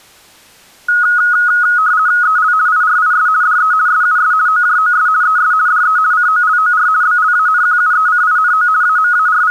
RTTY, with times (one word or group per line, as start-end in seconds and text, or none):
2.2-2.5 EL
2.7-3.3 IRIS
3.4-3.7 DE
3.9-4.3 SUS
4.5-5.1 OJOS
5.2-5.5 ES
5.7-6.0 DE
6.1-6.9 COLOR
7.0-8.7 BLANQUECINO
8.8-9.5 …